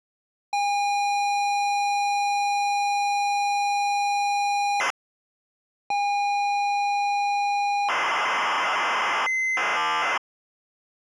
ZX Spectrum tape loading, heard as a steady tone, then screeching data.